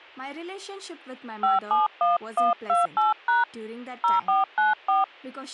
DTMF, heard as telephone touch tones, dialled by hand, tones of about 160 ms, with speech in English. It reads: 571128# 0494